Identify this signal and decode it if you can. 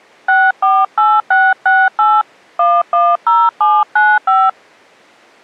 DTMF, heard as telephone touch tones, dialled by hand, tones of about 230 ms. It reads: 648668 110795